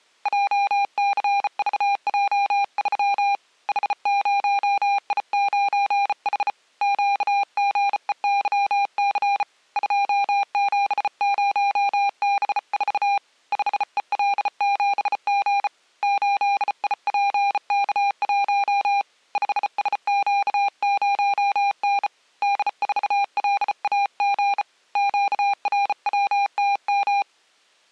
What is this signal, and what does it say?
Morse code, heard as a keyed tone, hand-sent with a bug key, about 34 wpm, 800 Hz. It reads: JCVJ3 H0I9H QGEYC 270B4 5EL7G 8IPK1 5SQ0N D4LAG QRWTM